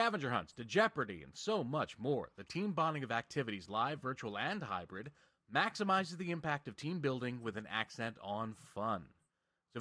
Speech in English. There is no code.